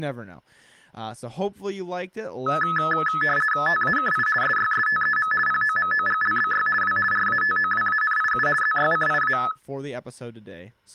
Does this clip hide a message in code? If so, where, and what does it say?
Yes: RTTY (50 baud, 450 Hz shift) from 2.5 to 9.5 s, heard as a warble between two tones, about 1500 Hz centre, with speech in English. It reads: TAKI SYSTEM POMOGLBY W RATOWANIU ZYCIA